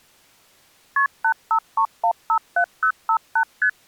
Multi-frequency trunk signalling (R1, as on North American trunks), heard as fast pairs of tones, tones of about 80 ms. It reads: KP 853157058 ST